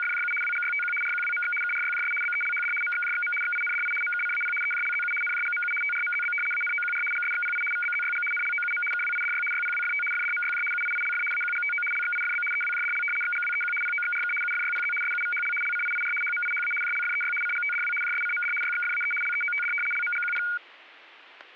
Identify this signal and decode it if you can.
RTTY (75 baud, 850 Hz shift), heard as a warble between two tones, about 1850 Hz centre, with static crashes. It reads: … WGYTQ RQWMX KRYJS BELHD MXJXM XINDI MKCAP EJLZU NJGMU TRMZB ANOQR GSXPI VBZYG NLOUM KWIDY YPWFT FDMYJ UIILF AQGTO LXIFB EWJDL XGWEQ POXRK UFYPZ SUVHL LCIIR HMIHA JLFEY CGTDW JSCMD YXFAE LEOTD LMGQP